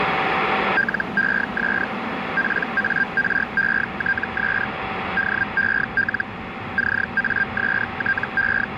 Hellschreiber (Feld-Hell, 122.5 baud), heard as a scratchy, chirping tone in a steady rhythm, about 1600 Hz, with radio static, a steady whistle near 770 Hz and the noise of a subway station. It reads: LES PARETS DEL …